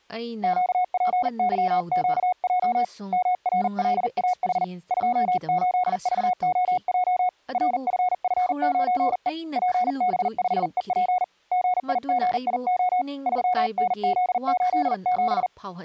Morse code, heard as a keyed tone, hand-sent with a paddle, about 40 wpm, 730 Hz, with speech in Manipuri. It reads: QPYQJ MRLAH 28VOJ RFF9E PB5EP GIGIO 3NZ87